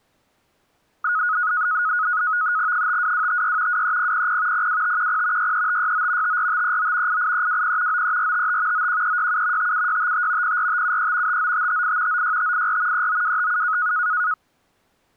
NAVTEX (SITOR-B), 100 baud, 170 Hz shift, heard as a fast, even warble, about 1360 Hz centre. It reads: 52256 23000 02510 63569 54539 88320 93455 91367 57655 04573 59558 96584 39257